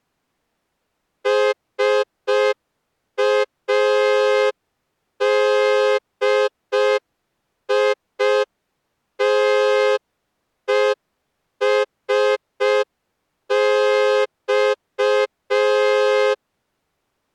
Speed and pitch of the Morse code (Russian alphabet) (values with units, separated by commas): 5 wpm